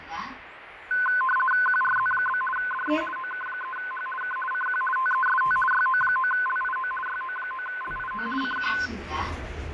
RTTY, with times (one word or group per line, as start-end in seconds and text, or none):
1.7-2.4 QRZ?
2.6-3.0 DE
3.2-4.1 OK3H
4.2-4.4 K
4.5-4.8 CQ
5.0-5.6 TEST
5.7-6.9 YO9LIO
7.1-8.3 YO9LIO
8.4-8.7 CQ